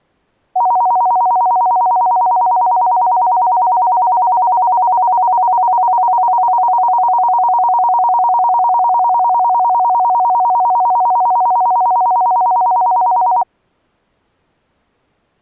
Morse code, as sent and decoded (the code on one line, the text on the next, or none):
none